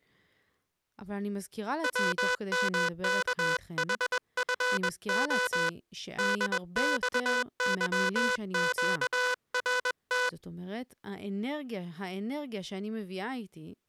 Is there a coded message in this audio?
Yes: Morse code (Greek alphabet) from 1.8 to 10.4 s, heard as a buzzer, hand-sent with a bug key, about 21 wpm, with speech in Hebrew. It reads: ΩΜΚΗΦΟ ΔΞΥΨΡΤ